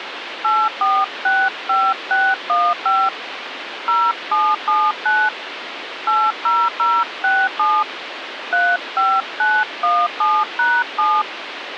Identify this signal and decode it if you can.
DTMF, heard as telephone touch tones, dialled by hand, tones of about 240 ms, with phone line noise. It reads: 8465615 0779 80067 35917#7